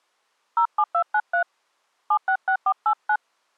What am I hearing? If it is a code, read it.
DTMF, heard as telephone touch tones, dialled by hand, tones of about 80 ms. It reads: 07293 766489